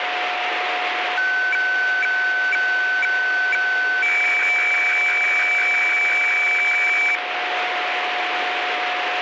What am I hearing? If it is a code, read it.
Weather fax (radiofax), 120 lines a minute, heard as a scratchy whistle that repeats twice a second, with radio static and a steady whistle near 720 Hz.